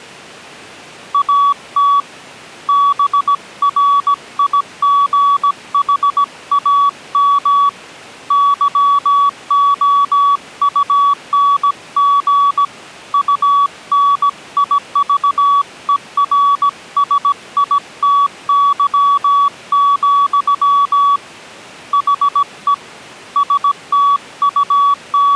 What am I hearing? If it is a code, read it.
Morse code, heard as a keyed tone, hand-sent with a paddle, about 17 wpm, 1140 Hz. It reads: AT BRIGHAM YOUNG UNIVERSITY, HE …